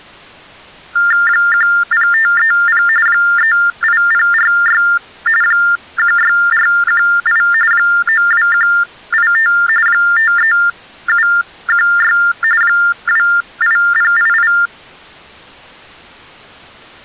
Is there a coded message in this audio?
Yes: TTY/TDD text telephone tones (45.45 baud Baudot) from 1.0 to 14.7 s, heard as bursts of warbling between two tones, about 400 Hz shift, 1600 Hz centre. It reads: 10530 38046 16418 92185 53716 28088